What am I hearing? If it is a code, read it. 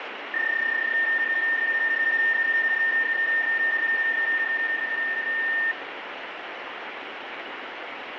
PSK31 (31.25 baud), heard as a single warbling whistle, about 1800 Hz, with radio static and room echo.